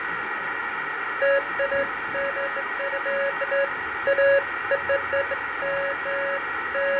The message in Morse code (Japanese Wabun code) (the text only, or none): none